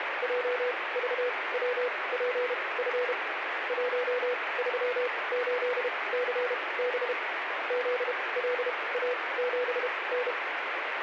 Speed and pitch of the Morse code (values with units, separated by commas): 32 wpm, spaced as for 22 wpm, 500 Hz